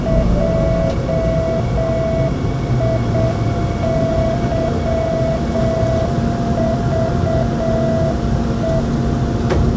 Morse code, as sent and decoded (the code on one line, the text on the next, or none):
.--- .. -.-- ...- .
JIYVE